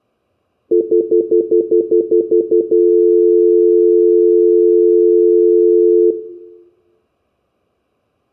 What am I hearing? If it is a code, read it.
Telephone call progress tone (North American plan), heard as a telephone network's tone, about 350, 440 Hz, 0.1 s on and 0.1 s off, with room echo. Stutter dial tone.